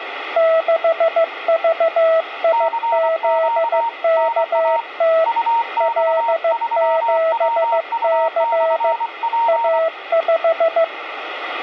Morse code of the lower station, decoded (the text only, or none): 6VIZKT L7C A5